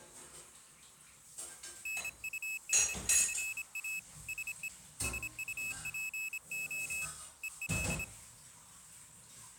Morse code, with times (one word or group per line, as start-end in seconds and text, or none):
1.9-4.0 NUNCA
4.3-4.7 SE
5.0-7.0 SUPO
7.4-8.0 EL